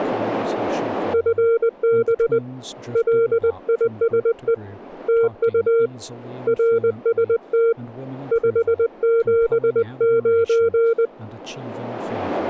Morse code, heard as a keyed tone, hand-sent with a paddle, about 20 wpm, 460 Hz, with speech in English. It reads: FB LISE TU RST 579